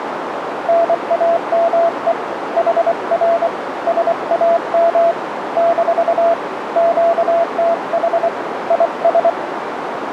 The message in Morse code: NAME HR SAM - QTH IS

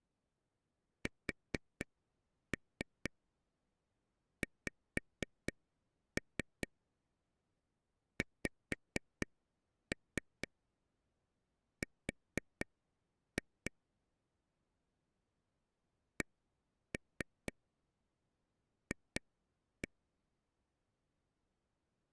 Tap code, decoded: SXXR CF

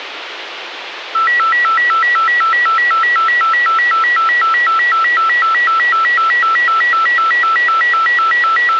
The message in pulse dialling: none

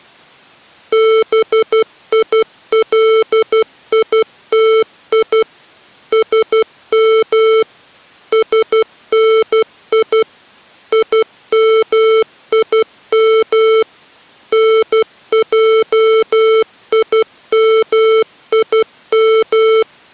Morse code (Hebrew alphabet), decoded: ביליתי שם שני ימים נעימים

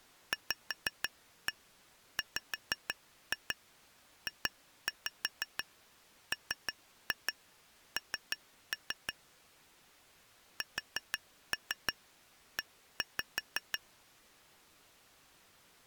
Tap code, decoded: VWJMN SE

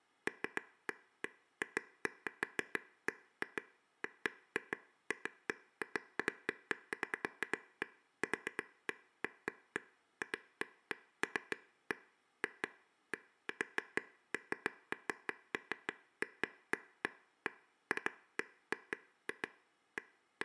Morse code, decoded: none

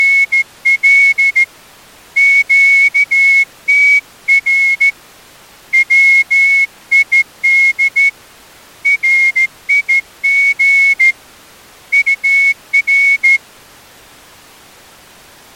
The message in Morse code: … QTR WID RIG UR

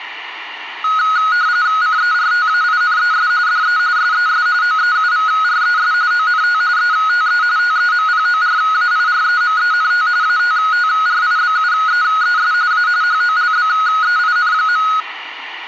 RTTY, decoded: CERTAINES DE SES OEUVRES ONT ETE TEMPORAIREMENT ATTRIBUEES A HOLBEIN.

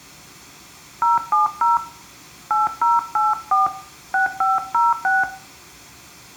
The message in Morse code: none

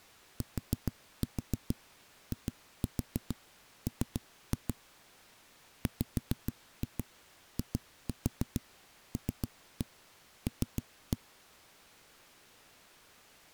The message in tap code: TIM WILL

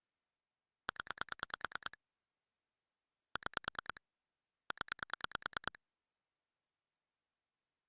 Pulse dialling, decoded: 0 6 0

